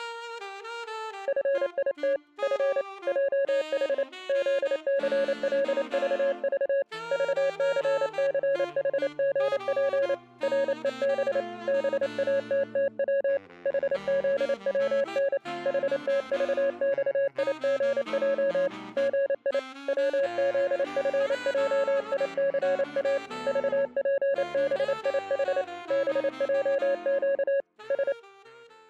Morse code, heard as a keyed tone, hand-sent with a paddle, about 28 wpm, 550 Hz. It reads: FIT F JH ZCLVV VCCHGP REB BATTW HZWN HTVXIGJ GI WZFJICA VPBIH BJQ S